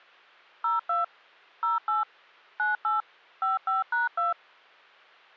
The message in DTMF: 02 08 98 55#2

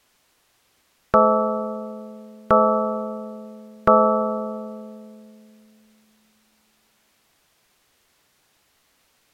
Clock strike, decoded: 3

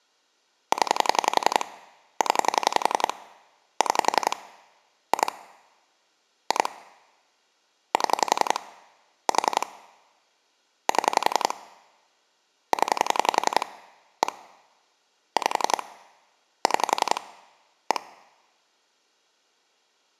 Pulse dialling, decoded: 0 0 6 2 2 7 4 7 0 1 5 6 1

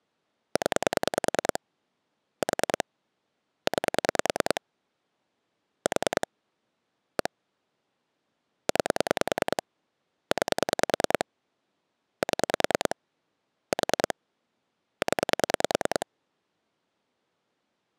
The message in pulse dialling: 0 4 9 4 1 9 9 7 4 0

